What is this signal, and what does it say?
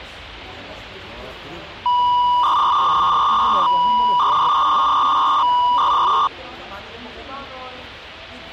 300-baud modem data (V.21 tones), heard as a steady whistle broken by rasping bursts, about 300 baud, 200 Hz shift, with the noise of a restaurant.